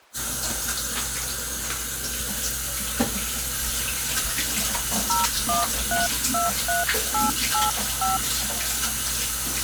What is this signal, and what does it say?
DTMF, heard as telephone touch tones, dialled by hand, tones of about 160 ms, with kitchen noise. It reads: 01323885